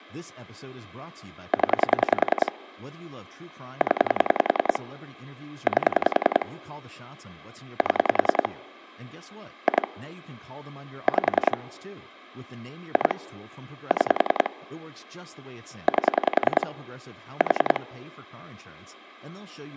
Pulse dialling, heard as clicks on a phone line, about 10 pulses a second, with speech in English. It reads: 0 0 8 7 2 5 2 6 8 4